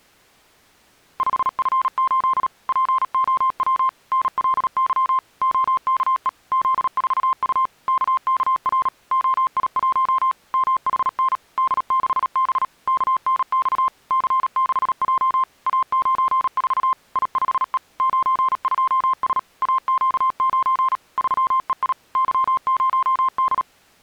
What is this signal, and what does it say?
Morse code, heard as a keyed tone, machine-sent, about 37 wpm, 1050 Hz. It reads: 5F8 POW NLY OKE Z4U KKR OI1 MHN D6B KNX C6J A94 I5E 92S AQ9 3EI Y0D